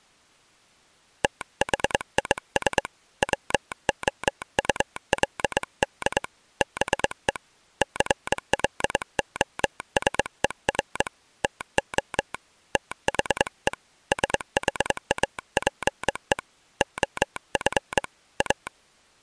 Morse code, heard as a telegraph sounder, hand-sent with a straight key, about 22 wpm. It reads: THIS WOULD BE CLOSER TO THE SHAPE OF A